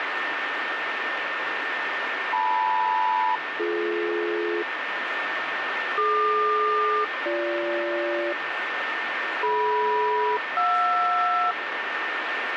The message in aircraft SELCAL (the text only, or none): LM-BD DQ-BG DM-JR